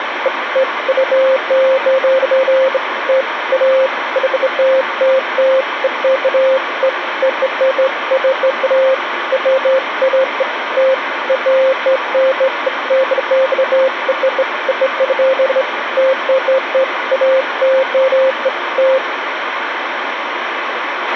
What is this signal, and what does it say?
Beeps of irregular length, with radio hiss and a squelch burst at the end. There is no code.